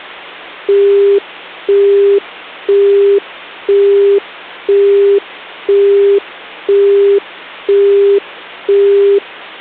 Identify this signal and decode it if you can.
Telephone call progress tone (single-tone plan, as in Europe, Japan and elsewhere), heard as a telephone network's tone, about 400 Hz, 0.5 s on and 0.5 s off, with hum. Busy tone.